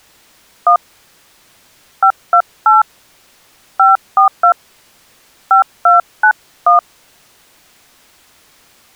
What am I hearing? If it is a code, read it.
DTMF, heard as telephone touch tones, dialled by hand, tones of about 110 ms. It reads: 1 528 542 5291